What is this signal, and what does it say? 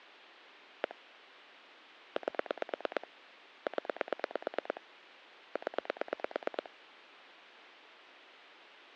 Pulse dialling, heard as clicks on a phone line, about 9 pulses a second. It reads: 1 8 0 0